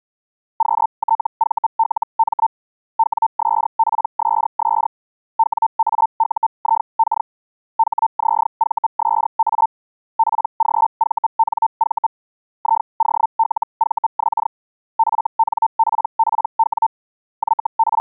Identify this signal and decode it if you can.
Hellschreiber (Feld-Hell, 122.5 baud), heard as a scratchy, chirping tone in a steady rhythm, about 900 Hz. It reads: QTVLM WSPSS WAUIK HZVSA PGVNV IOLVX FNPPW …